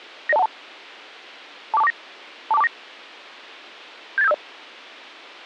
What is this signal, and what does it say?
Five-tone selective call (EIA), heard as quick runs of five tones, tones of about 30 ms. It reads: 90212 24249 24249 78750